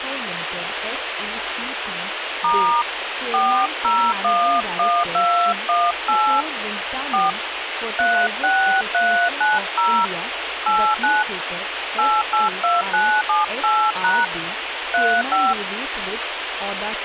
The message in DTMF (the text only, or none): * 4011218 4 36390 89 882978# 35